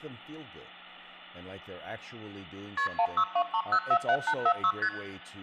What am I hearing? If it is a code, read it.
Multi-frequency trunk signalling (R1, as on North American trunks), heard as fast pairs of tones, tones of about 70 ms, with hum, room echo and speech in English. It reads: KP 1623047846 ST